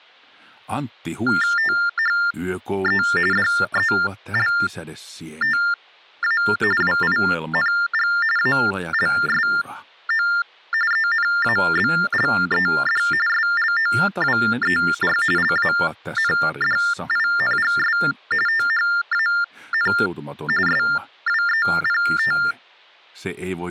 TTY/TDD text telephone tones (45.45 baud Baudot), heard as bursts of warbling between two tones, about 400 Hz shift, 1600 Hz centre, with hum. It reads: THE DELTA WING ALSO ENABLED SLOWER LANDINGS THAN SWEPT